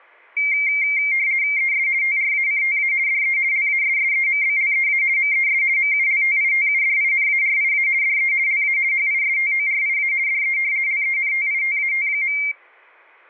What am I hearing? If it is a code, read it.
RTTY (50 baud, 170 Hz shift), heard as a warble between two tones, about 2200 Hz centre. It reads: ES TRACTA DE LASSEMBLEA MES MULTITUDINARIA DE LA HISTORIA DE LENTITAT.